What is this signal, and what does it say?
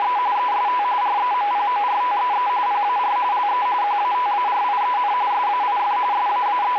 RTTY (45.45 baud, 170 Hz shift), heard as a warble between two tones, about 910 Hz centre, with radio static. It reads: … EST REMPORTEE PAR LE QATARIEN SAIF …